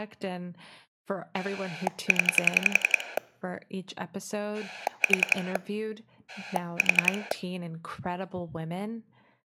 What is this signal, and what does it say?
Pulse dialling, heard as a rotary dial, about 11 pulses a second, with speech in English. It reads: 0 4 4